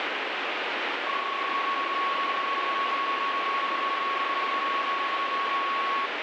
PSK31 (31.25 baud), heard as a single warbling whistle, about 1110 Hz, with radio static.